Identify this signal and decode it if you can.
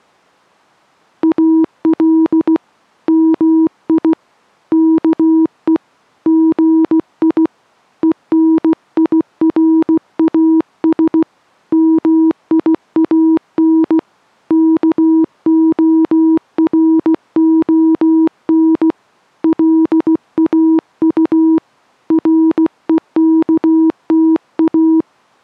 Morse code, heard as a keyed tone, hand-sent with a paddle, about 16 wpm, 320 Hz. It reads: AL MI KE GI ENIRAS MIAN KORON LAU REKTA